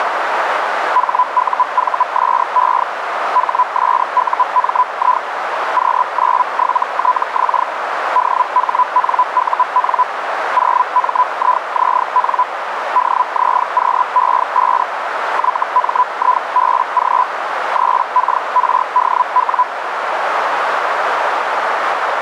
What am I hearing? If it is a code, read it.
Hellschreiber (Feld-Hell, 122.5 baud), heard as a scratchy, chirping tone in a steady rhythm, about 1000 Hz, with radio static and a narrow filter. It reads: HUVSE HSUMI Q97TX DHNUN 0MIZN DZQE5 YMIBG 3KRDW